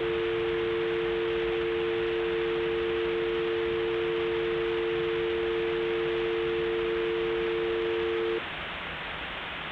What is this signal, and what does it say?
Telephone call progress tone (North American or UK plan), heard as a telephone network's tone, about 350, 450 Hz, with phone line noise and the noise of a subway station. Dial tone.